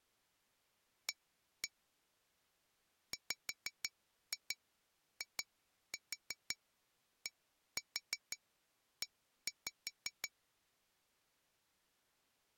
Tap code, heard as taps on glass, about 5 knocks a second. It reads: A WIDE